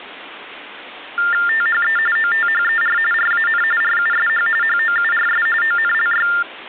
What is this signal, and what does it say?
TTY/TDD text telephone tones (45.45 baud Baudot), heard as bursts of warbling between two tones, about 400 Hz shift, 1600 Hz centre. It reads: THE OTHER RAN RUSH HOURS ONLY